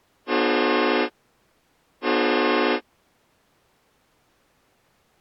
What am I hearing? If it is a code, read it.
Train horn signal, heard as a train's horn. 2 short. On North American railways: a signal is acknowledged.